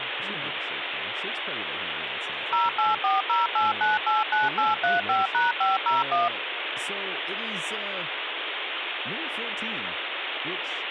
DTMF, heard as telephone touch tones, dialled by machine, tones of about 170 ms, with phone line noise and speech in English. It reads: 08408989835#501